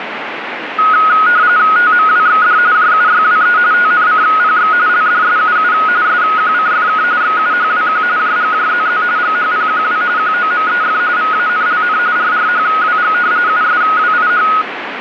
RTTY (45.45 baud, 170 Hz shift), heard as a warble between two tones, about 1360 Hz centre, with radio static. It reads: TMWXD JUYWE TNCPX LDSUU SQCFK XUHWQ JGJZZ GHPQW QOMEF VANLN RRHWG USWIH